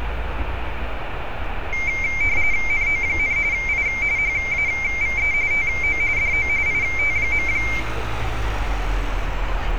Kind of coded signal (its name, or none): RTTY